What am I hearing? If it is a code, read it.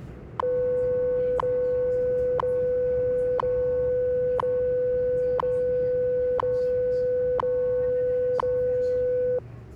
Radio time signal (WWV, Colorado), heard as ticks, one a second, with the noise inside a subway train.